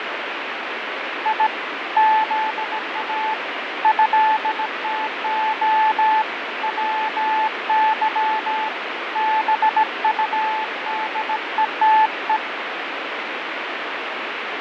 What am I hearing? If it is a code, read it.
Morse code (Russian alphabet), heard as a keyed tone, hand-sent with a bug key, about 17 wpm, 870 Hz, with heavy radio static and fading. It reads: И ЗА ЭТО ВЫ БУДЕТЕ